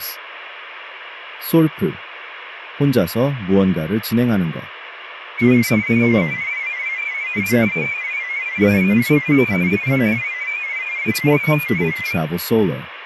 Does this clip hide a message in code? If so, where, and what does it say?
Yes: multi-tone FSK (Olivia or MFSK type), about 500 Hz wide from 5.4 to 12.2 s, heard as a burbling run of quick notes, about 31.25 baud, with radio static.